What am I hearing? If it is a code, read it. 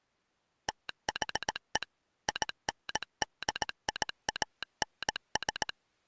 Morse code, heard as a telegraph sounder, machine-sent, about 18 wpm. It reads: THE INDIANS